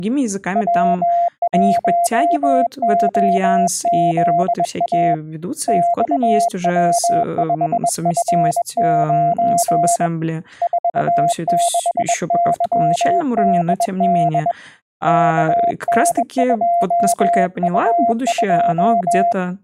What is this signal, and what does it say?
Morse code, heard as a keyed tone, hand-sent with a bug key, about 21 wpm, 690 Hz, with speech in Russian. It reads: W1OZA XW5F9 46YDD KN2U2